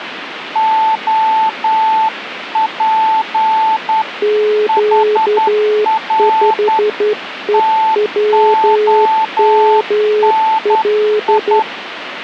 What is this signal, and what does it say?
Morse code, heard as two keyed tones, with radio static. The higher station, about 10 wpm, 880 Hz: OP HR TONI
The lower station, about 12 wpm, 420 Hz: Q5EWML